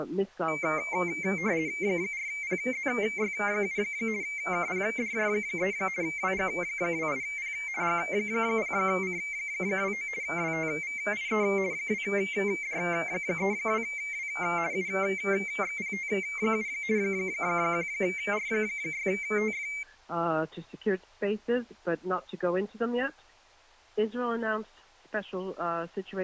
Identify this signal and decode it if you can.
RTTY (50 baud, 170 Hz shift), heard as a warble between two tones, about 2200 Hz centre. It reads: 4PZY7 KPDJ3 WG28P G0C29 WTVIE 2D32W UXPT7 1R6TF